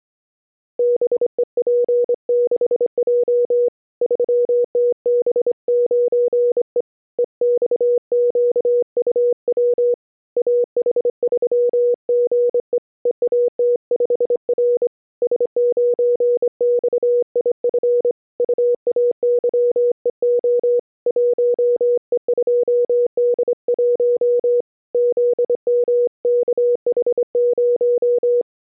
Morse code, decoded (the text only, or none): BEP6J 3TB9E EXQUW AH3GE EAT5R S9XIF UAYEO 1E2D1 ZMKH0